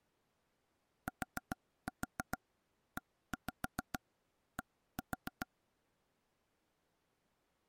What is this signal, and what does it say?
Tap code, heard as taps on a table, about 6 knocks a second. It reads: TED